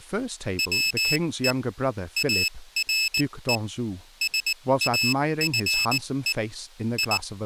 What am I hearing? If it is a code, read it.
Morse code, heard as a high beeper, machine-sent, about 19 wpm, spaced as for 16 wpm, 2600 Hz, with speech in English. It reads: WE ARE SAFE …